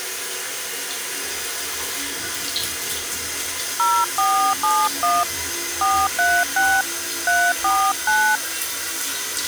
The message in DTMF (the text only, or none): 0471 436 349